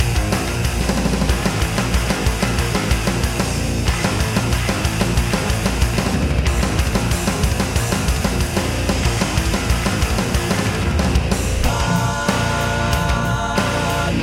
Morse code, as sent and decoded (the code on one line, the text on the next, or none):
none